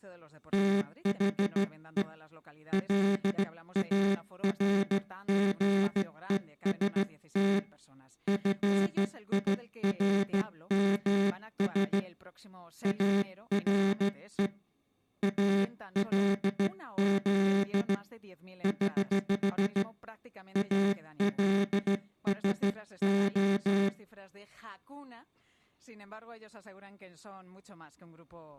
Morse code, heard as a buzzer, hand-sent with a straight key, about 15 wpm. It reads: THE LARGEST FIRMS ARE ALZ <HH> ALSO